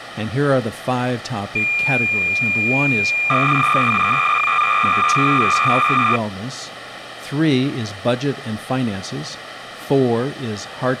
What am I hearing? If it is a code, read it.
Cassette data (Kansas City type), 300 baud, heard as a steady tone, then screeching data, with tape hiss and speech in English.